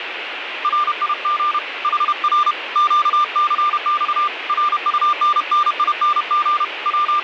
Morse code, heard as a keyed tone, hand-sent with a paddle, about 31 wpm, 1190 Hz, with radio static. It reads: RIG HR QCX RUNNING …